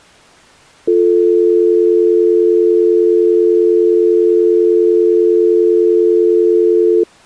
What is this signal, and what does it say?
Telephone call progress tone (North American or UK plan), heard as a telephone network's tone, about 350, 440 Hz. Dial tone.